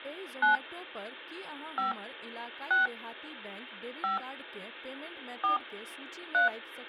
DTMF, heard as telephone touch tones, dialled by hand, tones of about 130 ms, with speech in Maithili. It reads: 9 5 6 5 4 3